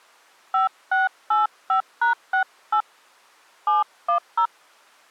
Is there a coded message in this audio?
Yes: DTMF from 0.5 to 4.5 s, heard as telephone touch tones, dialled by hand, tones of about 120 ms. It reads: 5685#68 710